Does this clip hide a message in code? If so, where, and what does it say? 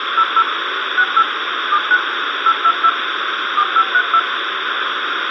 Yes: DTMF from 0.2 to 4.2 s, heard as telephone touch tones, dialled by machine, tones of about 60 ms, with radio hiss. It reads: 00 68 79 822 4532